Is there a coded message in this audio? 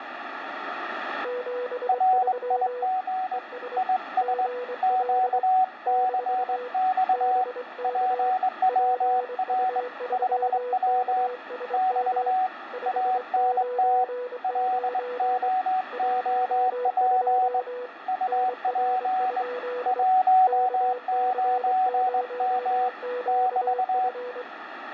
Yes: Morse code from 1.2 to 24.5 s, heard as two keyed tones, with radio static and room echo. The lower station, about 24 wpm, 490 Hz: 73 ES GL - BK PU3KSM 599 12 NR? KC0QF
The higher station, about 21 wpm, 750 Hz: RIG IS QCX PWR 5W <BT> ANT LOOP UP 19M <BT>